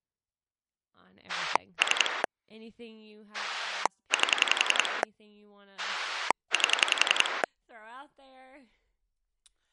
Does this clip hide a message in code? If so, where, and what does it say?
Yes: pulse dialling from 1.3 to 7.4 s, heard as a rotary dial, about 11 pulses a second, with speech in English. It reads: 3 8 8